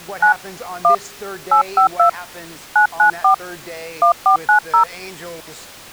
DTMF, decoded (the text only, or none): 9 1 852 994 1490